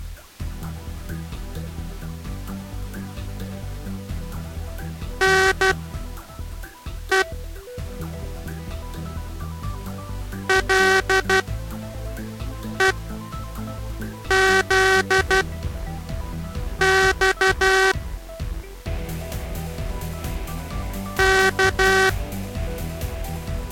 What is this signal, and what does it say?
Morse code (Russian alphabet), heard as a buzzer, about 12 wpm, spaced as for 5 wpm. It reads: НЕ ЛЕЗЬ К